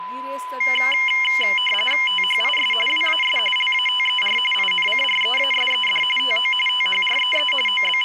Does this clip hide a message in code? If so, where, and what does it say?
Yes: RTTY (45.45 baud, 850 Hz shift) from 0.6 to 8.0 s, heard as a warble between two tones, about 2550 Hz centre, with a steady whistle near 1010 Hz and speech in Goan Konkani. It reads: THIS WAS LATER INCREASED TO THREE …